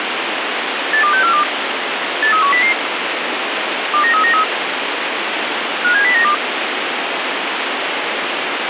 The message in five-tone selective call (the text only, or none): 82642 83100 29393 57092